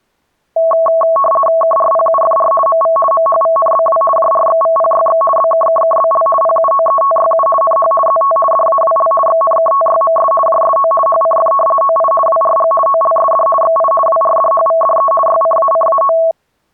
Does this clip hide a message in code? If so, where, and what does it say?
Yes: RTTY (50 baud, 450 Hz shift) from 0.6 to 16.3 s, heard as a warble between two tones, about 880 Hz centre. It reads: KRPUFR MV MHVNBW JRXVPYX BKKKBL PUOETYU NH ZT DAWL XNKTYMS JSO HCF OI WRG OLSD XI WRDHVDE YCACAO